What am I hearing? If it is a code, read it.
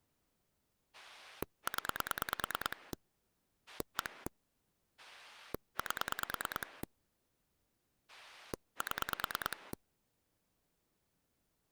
Pulse dialling, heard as a rotary dial, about 9 pulses a second. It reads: 0 1 8 7